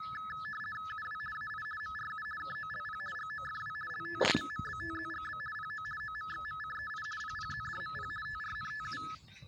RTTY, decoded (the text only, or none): UW AI MRU KOLP GOFW LT MMBTZGB PO OMXMCEI PPZDMP TRNTU